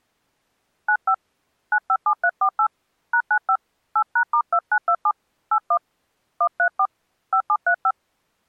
DTMF, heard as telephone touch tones, dialled by hand, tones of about 70 ms. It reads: 95 957348 #95 8#*2927 81 134 5735